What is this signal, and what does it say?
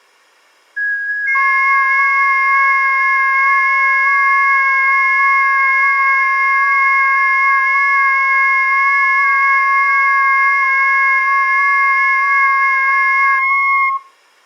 FT8 (several signals at once), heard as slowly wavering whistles, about 6.25 baud.